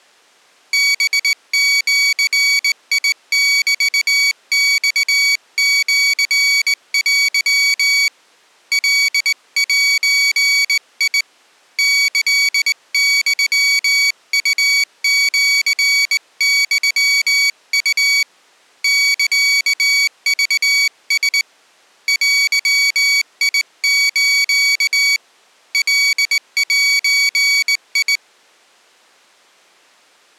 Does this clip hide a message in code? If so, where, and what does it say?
Yes: Morse code (Japanese Wabun code) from 0.7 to 28.2 s, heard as a high beeper, hand-sent with a straight key, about 19 wpm, 2250 Hz. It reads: ハジメマシテ カゼ キユウシユウ サクラ デス カゼ